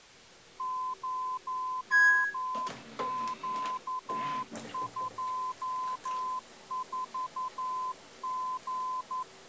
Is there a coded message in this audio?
Yes: Morse code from 0.5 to 9.3 s, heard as a keyed tone, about 11 wpm, 1020 Hz, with kitchen noise. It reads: 0Q24G